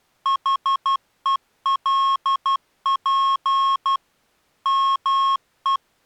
Morse code, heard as electronic beeps, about 12 wpm, 1090 Hz. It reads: HELP ME